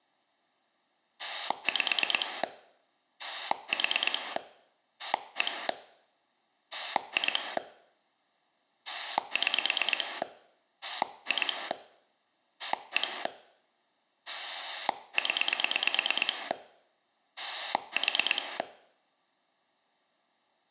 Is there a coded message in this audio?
Yes: pulse dialling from 1.2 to 18.6 s, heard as a rotary dial, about 9 pulses a second. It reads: 5 4 1 2 6 2 1 0 4